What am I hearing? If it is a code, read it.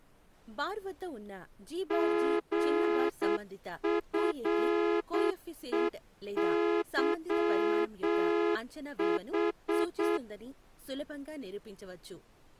Morse code, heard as a horn, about 8 wpm, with speech in Telugu. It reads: GFEYH